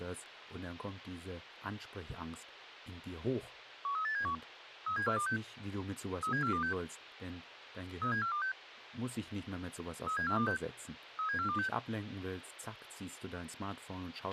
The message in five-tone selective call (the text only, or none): 13871 37426 37426 37426 37426 37426